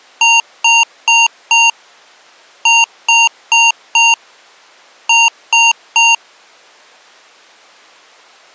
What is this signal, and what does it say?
Beep code, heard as beeps from a small speaker, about 920 Hz. 4-4-3. In Phoenix BIOS tables: maths coprocessor failure.